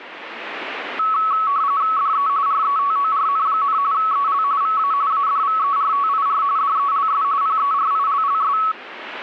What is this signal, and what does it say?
RTTY (45.45 baud, 170 Hz shift), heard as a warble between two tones, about 1210 Hz centre. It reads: DE RETORN, EL VA ADVERTIR DELS PERILLS